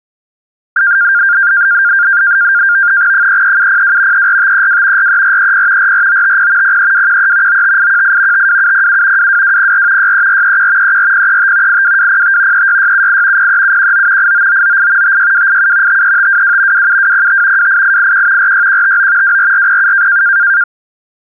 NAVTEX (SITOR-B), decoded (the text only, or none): 33702 34532 43430 44950 03213 95818 52707 22204 63431 34035 82205 36678 03719 89998 56287 53522 27205 28881 46159 24407